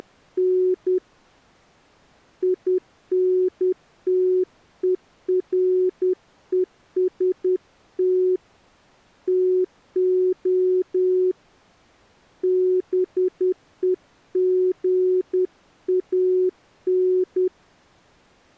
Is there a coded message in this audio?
Yes: Morse code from 0.0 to 17.5 s, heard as a keyed tone, hand-sent with a paddle, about 10 wpm, 370 Hz. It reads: … INTEREST TO BEGAN